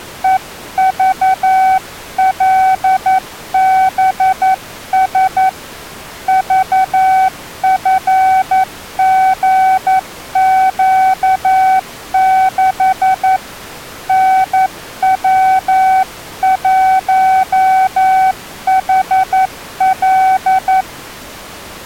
Morse code, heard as a keyed tone, hand-sent with a paddle, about 11 wpm, 760 Hz. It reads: EVLBS VFGQ6 NW1HL